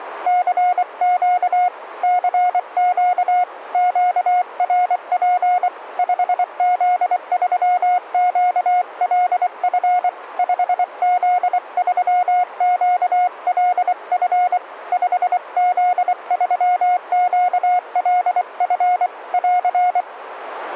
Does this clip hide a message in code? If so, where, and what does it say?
Yes: Morse code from 0.2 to 20.1 s, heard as a keyed tone, hand-sent with a paddle, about 24 wpm, 720 Hz. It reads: CQ CQ QRP 5Z3QLF 5Z3QLF 5Z3QLF <AR>